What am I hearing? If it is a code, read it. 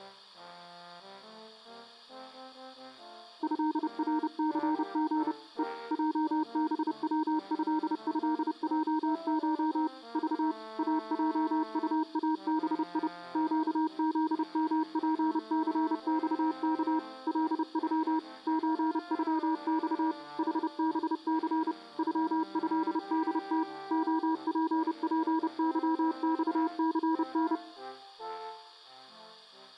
Morse code (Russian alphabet), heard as a keyed tone, machine-sent, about 30 wpm, 320 Hz. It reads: ЭРЦГ Е ЙБВЭЭЙШ Ж АЙУАБИ ЩЗМПЦЬК ЛЮ ЧЮЬ ХБЦ ЮЭДТ ОППЫЬЦН